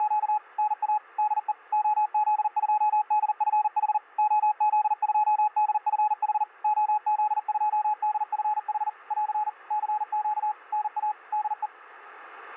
Morse code, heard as a keyed tone, machine-sent, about 40 wpm, 850 Hz. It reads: … NA DE OZ2DFH OZ2DFH OZ2DFH <AR> CQ NA DE